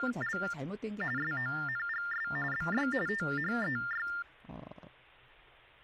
TTY/TDD text telephone tones (45.45 baud Baudot), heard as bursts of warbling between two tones, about 400 Hz shift, 1600 Hz centre, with speech in Korean. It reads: … SONGS BY THEY